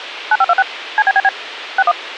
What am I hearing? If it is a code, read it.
DTMF, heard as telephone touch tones, dialled by machine, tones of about 40 ms, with radio hiss. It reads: 9526 CBBB 61